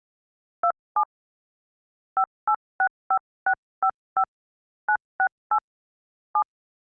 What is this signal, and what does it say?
DTMF, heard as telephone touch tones, dialled by hand, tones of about 70 ms. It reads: 27 5865655 968 7